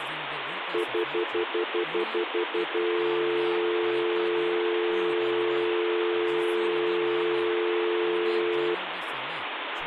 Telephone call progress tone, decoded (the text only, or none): stutter dial tone